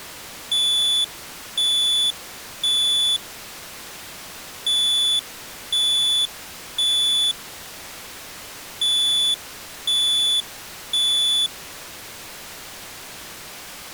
Alarm pattern, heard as an alarm's beeps, played three times, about 3450 Hz. Temporal three. Smoke or fire, evacuate.